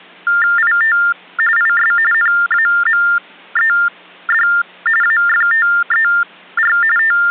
TTY/TDD text telephone tones (45.45 baud Baudot), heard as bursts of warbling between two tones, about 400 Hz shift, 1600 Hz centre. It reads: IT IS NAMED AFTER …